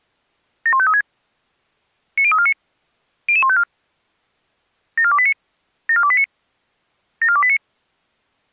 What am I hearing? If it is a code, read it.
Five-tone selective call (ZVEI), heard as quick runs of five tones, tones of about 70 ms. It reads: 71536 90349 00154 74289 74289 74289